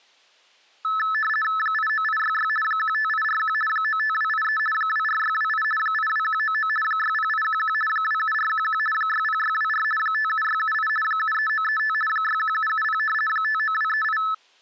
RTTY (50 baud, 450 Hz shift), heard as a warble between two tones, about 1500 Hz centre. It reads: 89866 15841 95283 24628 82199 60811 27411 60624 57678 73935 61770 59238